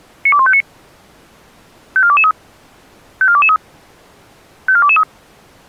Five-tone selective call (ZVEI), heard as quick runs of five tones, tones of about 70 ms. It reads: 92159 54223 54223 54223